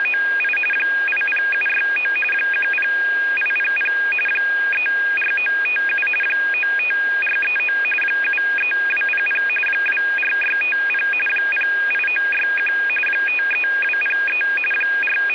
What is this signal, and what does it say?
RTTY (45.45 baud, 850 Hz shift), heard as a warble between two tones, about 2050 Hz centre, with radio static. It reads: … 80769 10800 34957 95439 73200 24650 08961 53203 …